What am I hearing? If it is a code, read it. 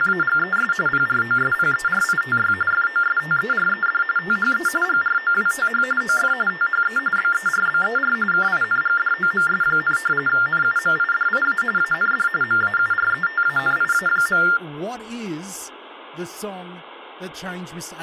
TTY/TDD text telephone tones (45.45 baud Baudot), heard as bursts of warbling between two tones, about 400 Hz shift, 1600 Hz centre, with speech in English. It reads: … PROSPERITY FOSTERED THE GROWTH OF THE BERBER KINGDOMS, NUMIDIA AND MAURETANIA.